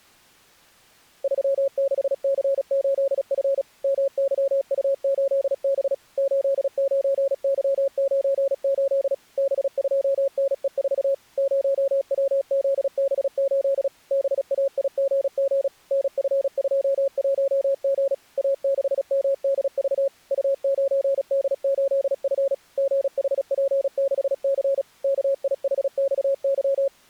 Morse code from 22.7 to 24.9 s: GHP6C

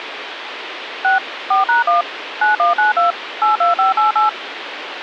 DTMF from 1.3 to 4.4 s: 4#1 9192 82588

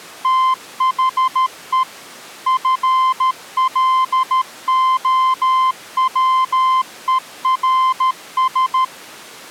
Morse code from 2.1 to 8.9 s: FLOWERS

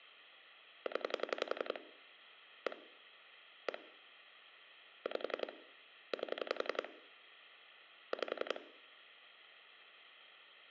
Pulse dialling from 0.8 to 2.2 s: 0

